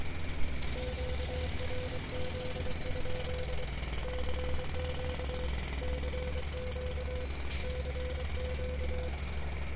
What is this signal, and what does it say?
Morse code, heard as a keyed tone, hand-sent with a paddle, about 24 wpm, 500 Hz, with radio static, a steady whistle near 1660 Hz and street noise. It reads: QRZ? CQ CQ CQ